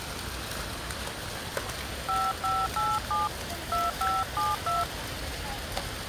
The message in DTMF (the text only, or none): 5587 2572